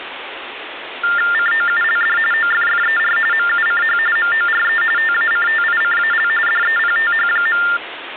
TTY/TDD text telephone tones (45.45 baud Baudot), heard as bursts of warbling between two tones, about 400 Hz shift, 1600 Hz centre, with phone line noise. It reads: COULD OFFER MUCH MORE TACTICAL DEPTH.